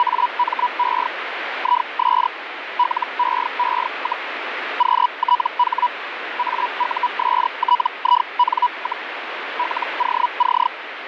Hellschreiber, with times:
0.0-1.1 …
1.6-2.3 IS
2.8-4.3 LEE,
4.8-5.9 QTH
6.4-9.1 AUSTIN,
9.6-10.7 LOC

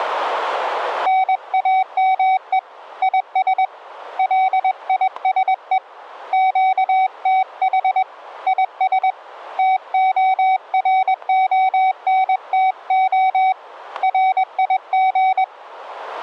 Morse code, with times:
1.1-2.6 NAME
3.0-3.6 IS
4.2-5.8 LISE
6.3-8.0 QTH
8.5-9.1 IS
9.6-13.5 TORONTO
14.0-15.4 RIG

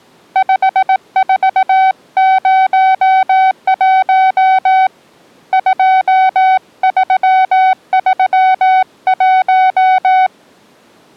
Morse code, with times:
0.4-4.9 5401
5.5-10.3 2331

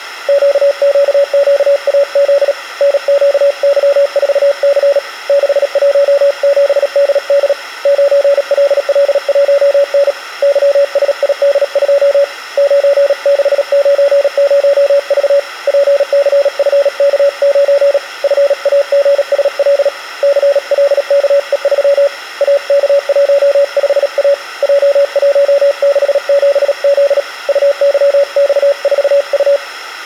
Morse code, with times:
0.3-2.5 QQQAZ
2.8-5.0 NQY4C
5.3-7.5 617DD
7.9-10.1 9LL1N
10.4-12.2 YSID2
12.6-15.4 9690V
15.7-18.0 PCFK9
18.2-19.9 FAGSL
20.2-22.1 CLKE3
22.4-24.3 AK15A
24.6-27.2 J167Z
27.5-29.6 UYX4U

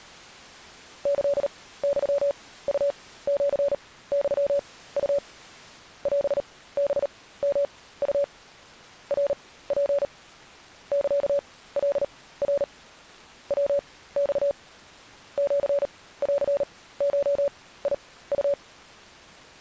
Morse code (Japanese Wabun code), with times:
1.1-5.2 キユウシユウ
6.1-8.2 オハヨウ
9.1-10.0 ナツ
10.9-12.6 サカナ
13.5-14.5 ヤマ
15.4-18.5 シンゴウ

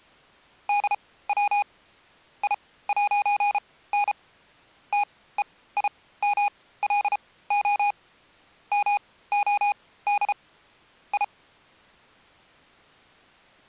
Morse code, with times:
0.7-1.6 DW
2.4-4.1 I'N
4.9-7.9 TEIMLO
8.7-10.3 MOD
11.1-11.2 I

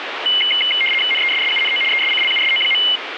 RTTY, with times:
1.1-1.8 NESSUNO
1.9-2.8 ESCLUSO.

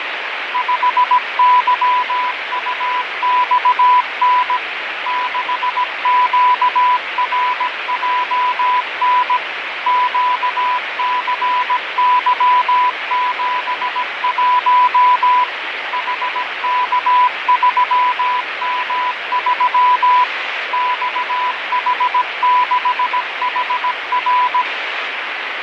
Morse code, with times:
0.5-4.6 5YUXN
5.1-9.4 6QRJN
9.9-15.4 QCY71
15.9-20.2 HK3M3
20.7-24.6 XH6HR

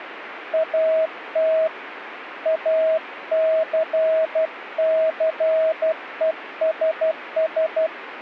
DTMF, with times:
none

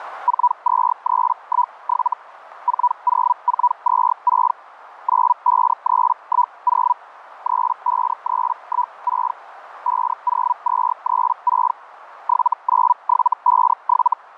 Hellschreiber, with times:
0.3-2.1 42317
2.7-4.5 40426
5.1-6.9 95310
7.5-9.3 35316
9.9-11.7 50236
12.3-14.1 79757

